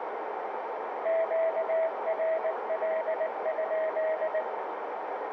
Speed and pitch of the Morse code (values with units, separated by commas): 19 wpm, 640 Hz